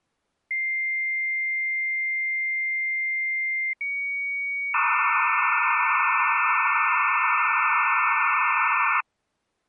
Dial-up modem handshake (low-speed, two carriers), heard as two whistles, then hiss.